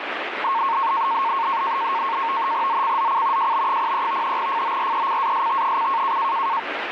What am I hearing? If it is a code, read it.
NAVTEX (SITOR-B), 100 baud, 170 Hz shift, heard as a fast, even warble, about 1000 Hz centre, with radio static. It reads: ZCZC JB03 FORECAST: